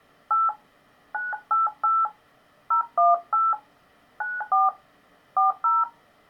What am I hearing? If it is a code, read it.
DTMF, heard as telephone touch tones, dialled by hand, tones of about 160 ms. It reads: 8 988 018 94 40